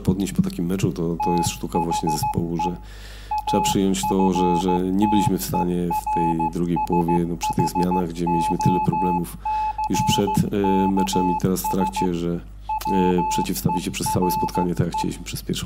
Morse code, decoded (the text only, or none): THE AFTERSHOCKS WERE